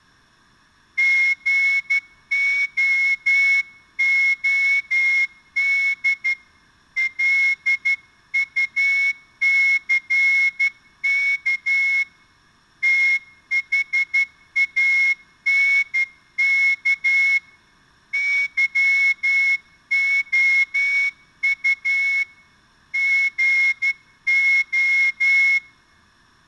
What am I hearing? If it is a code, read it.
Morse code, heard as a whistle, hand-sent with a straight key, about 12 wpm. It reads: GOOD LUCK THANK YOU GO